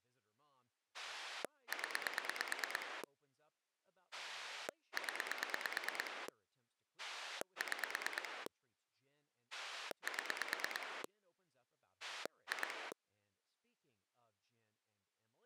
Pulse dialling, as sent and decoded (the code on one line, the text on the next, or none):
10 / 10 / 6 / 7 / 2
0 0 6 7 2